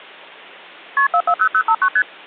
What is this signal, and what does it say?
Multi-frequency trunk signalling (R1, as on North American trunks), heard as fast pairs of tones, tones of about 70 ms. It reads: KP 440059 ST